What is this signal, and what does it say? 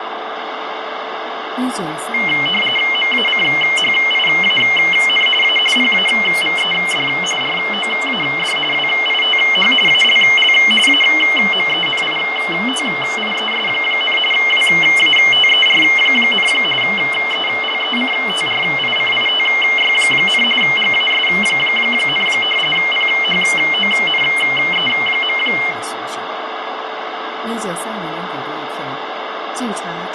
RTTY (45.45 baud, 850 Hz shift), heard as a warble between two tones, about 2550 Hz centre, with radio static, fading, a steady whistle near 440 Hz, room echo and speech in Chinese. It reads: MACHIAN A PAVED ROAD WITH ALL AMENITIES, WATER, ELECTRICITY, GAS, PHONE.